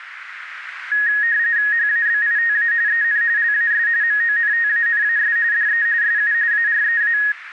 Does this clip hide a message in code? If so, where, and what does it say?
Yes: RTTY (45.45 baud, 170 Hz shift) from 0.9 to 7.3 s, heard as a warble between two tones, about 1750 Hz centre, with radio static. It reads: HABITA EN LAS MONTANAS DE SU AREA